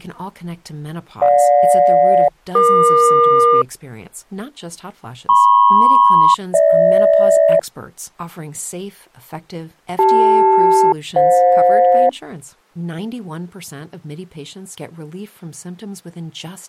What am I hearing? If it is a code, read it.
Aircraft SELCAL, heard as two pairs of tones, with speech in English. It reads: GJ-EQ MP-GH CL-FJ